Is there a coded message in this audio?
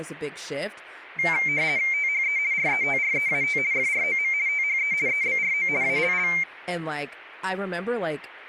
Yes: RTTY (50 baud, 170 Hz shift) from 1.2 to 6.4 s, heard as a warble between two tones, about 2200 Hz centre, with speech in English. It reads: THE RETREAT FROM THE EBRO ALL